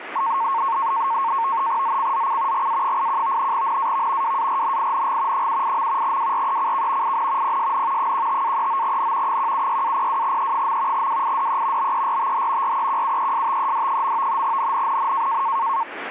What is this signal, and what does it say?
NAVTEX (SITOR-B), 100 baud, 170 Hz shift, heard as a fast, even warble, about 1000 Hz centre, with radio static. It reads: ZCZC GA81 NAV WARNING 78. WRECK IN PSN 15-39N 176-02E. WIDE BERTH REQUESTED. NNNN